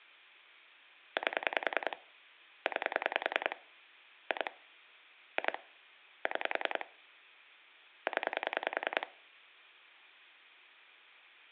Pulse dialling, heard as clicks on a phone line, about 10 pulses a second, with hum. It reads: 8 9 2 2 6 0